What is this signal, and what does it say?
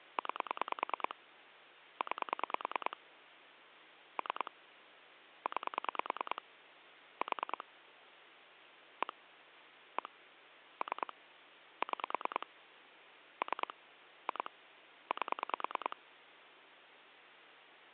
Pulse dialling, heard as clicks on a phone line, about 9 pulses a second, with phone line noise. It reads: 9 9 3 9 4 1 1 3 6 3 2 8